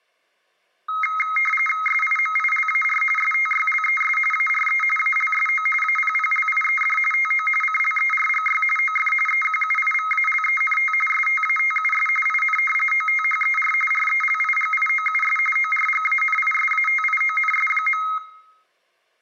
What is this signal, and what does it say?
RTTY (45.45 baud, 850 Hz shift), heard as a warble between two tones, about 1700 Hz centre, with room echo. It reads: SIMILAR STYLES ARE ALSO APPLIED TO CLERGY OF EQUIVALENT STATUS IN OTHER RELIGIOUS ORGANISATIONS.